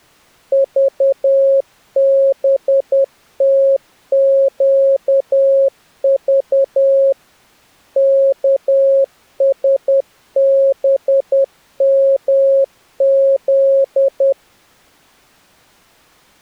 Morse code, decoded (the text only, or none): VBTQV KSBMZ